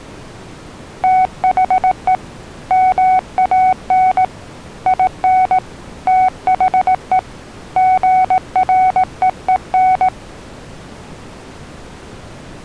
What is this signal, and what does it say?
Morse code, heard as a keyed tone, hand-sent with a paddle, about 18 wpm, 750 Hz. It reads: THE MAN IN THE GREEN